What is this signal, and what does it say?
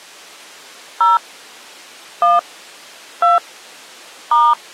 DTMF, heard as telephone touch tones, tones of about 160 ms. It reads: 0 1 2 *